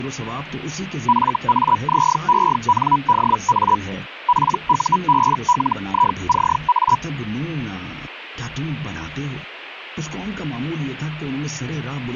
Hellschreiber (Feld-Hell, 122.5 baud), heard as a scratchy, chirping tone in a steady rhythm, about 980 Hz. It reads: FAZENDA PUBLICA